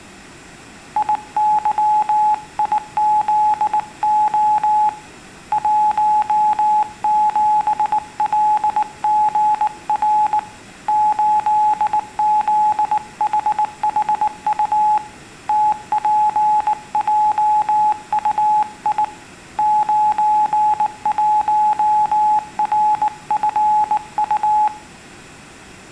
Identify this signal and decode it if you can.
Morse code, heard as a keyed tone, hand-sent with a bug key, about 19 wpm, 850 Hz, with room echo. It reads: IYIZO 17LGR 8ZHHU TPJUI 91RFU